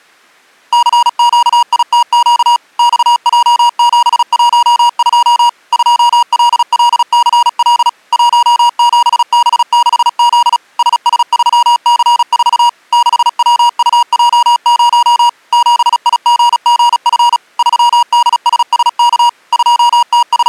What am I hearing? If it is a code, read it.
Morse code, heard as electronic beeps, machine-sent, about 36 wpm, 950 Hz. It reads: CQITQ XJ712 2LLCL 17B6Z SS3C4 6WUJ0 7IGGF 3DSSK …